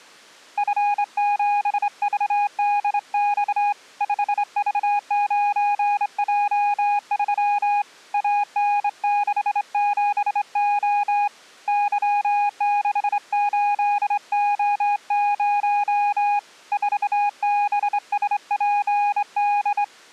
Morse code, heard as a keyed tone, hand-sent with a straight key, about 25 wpm, 820 Hz. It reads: F7VDX 5V9J3 AN67O Y68O0 4BSPD